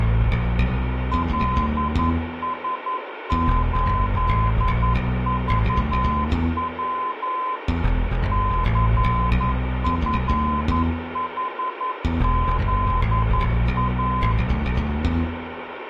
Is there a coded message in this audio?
Yes: Morse code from 1.1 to 14.4 s, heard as a keyed tone, machine-sent, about 11 wpm, 1020 Hz, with radio static and room echo. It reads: LS8VW CFHZA